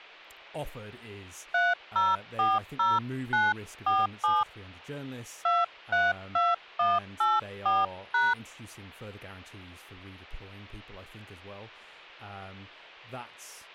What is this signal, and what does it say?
DTMF, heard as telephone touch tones, dialled by hand, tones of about 200 ms, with hum and speech in English. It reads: 3040947 232184#